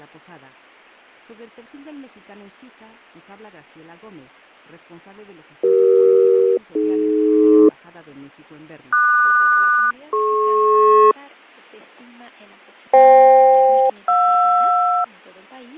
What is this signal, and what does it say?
Aircraft SELCAL, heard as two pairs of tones, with fading. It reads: CE-AD QS-DP FK-JR